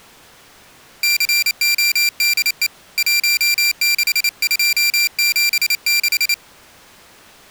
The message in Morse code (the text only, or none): CODE 16276